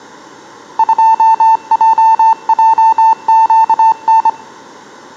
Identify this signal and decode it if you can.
Morse code, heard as a keyed tone, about 25 wpm, 890 Hz. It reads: 2JJQN